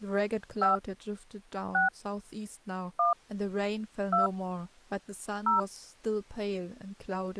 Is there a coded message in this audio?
Yes: DTMF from 0.6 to 5.6 s, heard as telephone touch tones, dialled by hand, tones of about 140 ms, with speech in English. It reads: 5 6 1 2 0